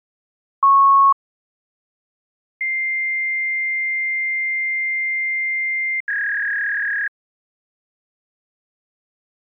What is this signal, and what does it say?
Fax machine handshake, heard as a beep, a long tone and a warble.